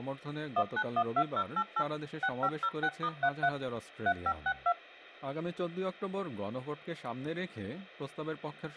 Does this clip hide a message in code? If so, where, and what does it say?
Yes: DTMF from 0.6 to 4.7 s, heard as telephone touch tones, dialled by machine, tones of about 60 ms, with speech in Hindi. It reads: 1912088 6506*33 3562